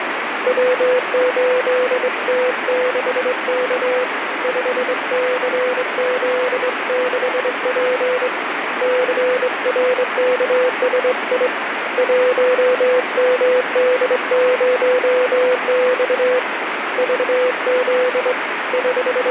Morse code, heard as a keyed tone, hand-sent with a straight key, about 23 wpm, 500 Hz, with radio static. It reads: W8T6K 5CZ6P CRKSI 1MD0X VZ …